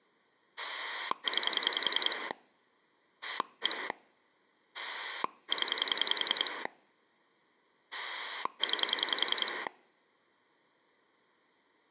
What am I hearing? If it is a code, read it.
Pulse dialling, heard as a rotary dial, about 10 pulses a second. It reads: 9 1 0 9